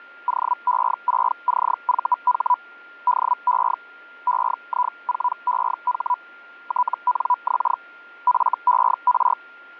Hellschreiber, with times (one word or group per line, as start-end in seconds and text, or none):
0.3-2.5 OE6CVH
3.1-3.7 DE
4.3-6.1 EI4EH
6.7-7.7 TNX
8.3-9.3 FER